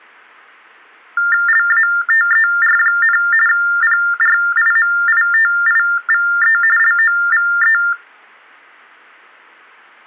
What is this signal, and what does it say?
TTY/TDD text telephone tones (45.45 baud Baudot), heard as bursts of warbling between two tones, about 400 Hz shift, 1600 Hz centre. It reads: LATER, PRIMITIVE LOVE